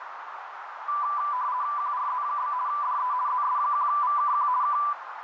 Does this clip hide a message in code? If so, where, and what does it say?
Yes: RTTY (50 baud, 170 Hz shift) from 0.9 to 4.9 s, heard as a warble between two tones, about 1090 Hz centre, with radio static and a narrow filter. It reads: QRZ? DE ZS1VKQ K